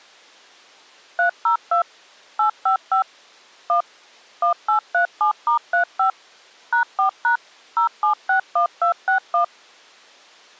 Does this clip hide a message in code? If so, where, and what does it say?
Yes: DTMF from 1.2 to 9.4 s, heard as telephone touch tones, dialled by machine, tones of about 110 ms. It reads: 302 855 1 1837*35 #4# 0761261